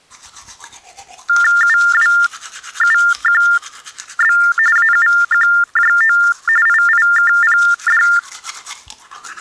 TTY/TDD text telephone tones (45.45 baud Baudot), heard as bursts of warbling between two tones, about 400 Hz shift, 1600 Hz centre, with the noise of a restroom. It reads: UWUQB AUQJO IIKPD